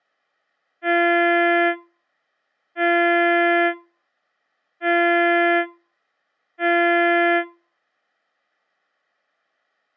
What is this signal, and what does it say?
Ship horn signal, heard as a ship's horn, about 340 Hz. 4 short. At sea: a pilot vessel's identity signal in fog.